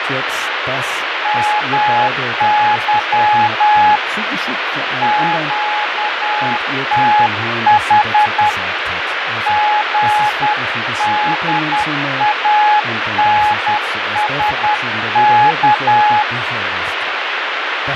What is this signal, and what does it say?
Morse code, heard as a keyed tone, hand-sent with a paddle, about 10 wpm, 840 Hz, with heavy radio static, fading and speech in German. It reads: MY QTH GDANSK